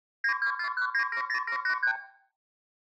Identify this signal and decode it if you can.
Multi-frequency trunk signalling (R2, with the far end's replies), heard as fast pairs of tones, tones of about 90 ms, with room echo. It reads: 9241970783